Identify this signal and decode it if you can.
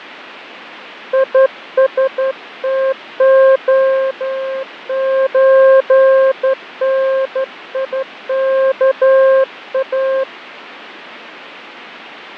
Morse code (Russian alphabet), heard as a keyed tone, hand-sent with a straight key, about 12 wpm, 530 Hz, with radio static and fading. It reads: ИСТОЧНИКА